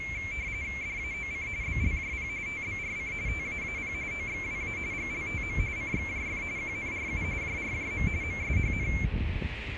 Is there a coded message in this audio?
Yes: RTTY (45.45 baud, 170 Hz shift) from 0.0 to 9.0 s, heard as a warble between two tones, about 2250 Hz centre, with radio static, a narrow filter and street noise. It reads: DAOC BLJP TBRC TAAP OXWA GLTM CXJF QNRU JRJM MSHN